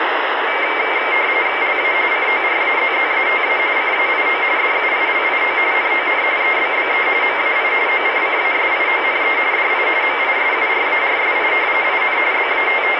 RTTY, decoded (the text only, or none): LA CORAZZATA CAIO DUILIO NON EBBE MAI OCCASIONE DI MISURARSI IN …